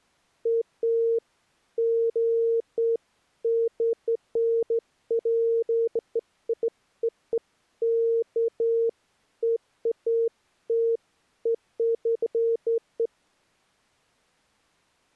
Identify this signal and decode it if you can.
Beeps of irregular length. There is no code.